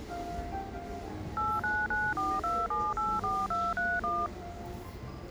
DTMF, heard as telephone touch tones, dialled by machine, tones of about 230 ms, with the noise of a cafe. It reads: 89942784231